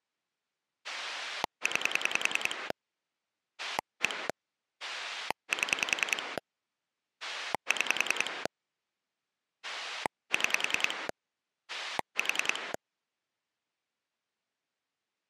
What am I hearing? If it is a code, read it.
Pulse dialling, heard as a rotary dial, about 10 pulses a second. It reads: 9 1 7 6 6 4